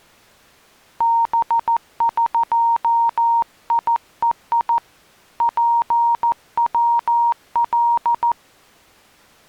Morse code (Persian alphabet), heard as a keyed tone, hand-sent with a paddle, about 14 wpm, 930 Hz. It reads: بقیهی پول